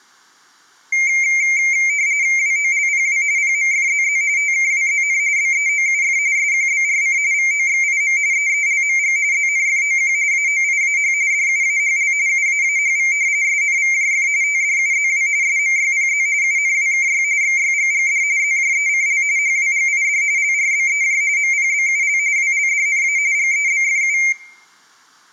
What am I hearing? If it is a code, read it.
RTTY (45.45 baud, 170 Hz shift), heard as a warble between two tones, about 2200 Hz centre, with room echo. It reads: WOLPW PMFZZ TKWZN BEOUF SQBRC VOXIM EELMG ZNFOQ AOIAH DUAHL UAAHV SNVJF TDUZW SMYPZ UNWKY XYGGD ZJECL HWGID LRBEJ MPBUL WLDNA GEBFU